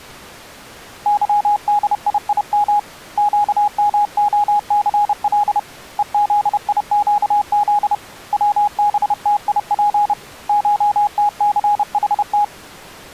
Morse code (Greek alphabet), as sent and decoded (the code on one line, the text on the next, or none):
-.-- -.. .. .. -- / --.- -- --- -.-. .-.. / . --.. .. --.- --.. / .-- -... - .. .--. / ---- - -.-. .... -
ΥΔΙΙΜ ΨΜΟΘΛ ΕΖΙΨΖ ΩΒΤΙΠ ΧΤΘΗΤ